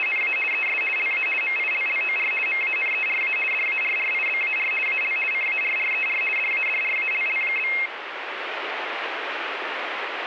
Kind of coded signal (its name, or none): RTTY